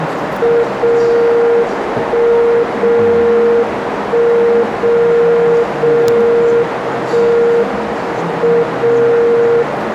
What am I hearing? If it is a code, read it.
Radio time signal (WWVB), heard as a tone whose level steps once a second, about 470 Hz, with radio static, a narrow filter and the noise of a cafe. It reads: 0 1 0 1 0 0 1 M 0